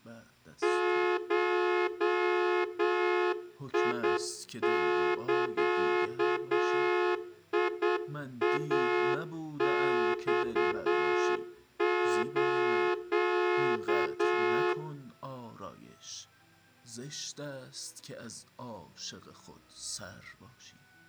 Morse code (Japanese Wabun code), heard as a horn, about 8 wpm, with room echo. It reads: ゴザイマス